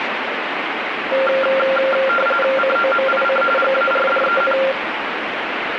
RTTY (45.45 baud, 850 Hz shift), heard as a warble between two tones, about 960 Hz centre, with radio static. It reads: COMIC GARDEN